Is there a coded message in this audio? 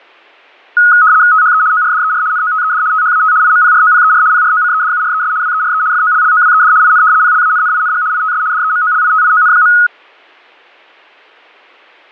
Yes: RTTY (75 baud, 170 Hz shift) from 0.8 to 9.9 s, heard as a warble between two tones, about 1360 Hz centre. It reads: THE ORDER NOTED THAT IMPROPER PROCEDURES WERE FOLLOWED IN PLANNING ITS DEMOLITION.